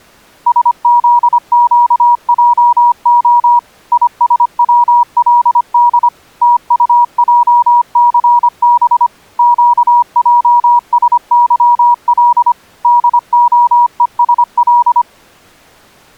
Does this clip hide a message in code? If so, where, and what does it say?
Yes: Morse code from 0.4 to 15.1 s, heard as a keyed tone, machine-sent, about 25 wpm, 960 Hz. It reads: SZQJO ISWLD TUJCB QJSYL DOESL